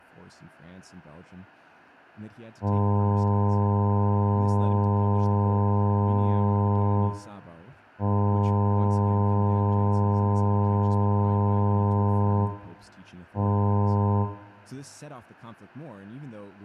Ship horn signal, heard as a ship's horn, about 100 Hz, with room echo and speech in English. 2 long, 1 short. At sea: I intend to overtake on your starboard side.